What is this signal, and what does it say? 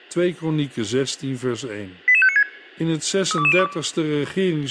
Five-tone selective call (ZVEI), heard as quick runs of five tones, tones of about 70 ms, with speech in Dutch. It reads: 88596 32202